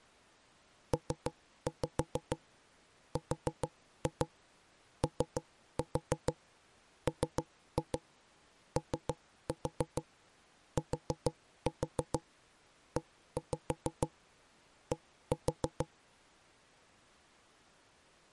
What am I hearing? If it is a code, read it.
Tap code, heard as knocks on wood, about 6 knocks a second. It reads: PROMOTED